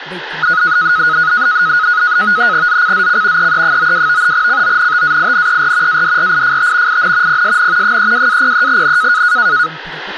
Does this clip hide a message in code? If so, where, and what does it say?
Yes: NAVTEX (SITOR-B), 100 baud, 170 Hz shift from 0.4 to 9.7 s, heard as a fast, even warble, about 1360 Hz centre, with radio static and speech in English. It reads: ZCZC EE92 CONTAINER ADRIFT IN PSN 32-03N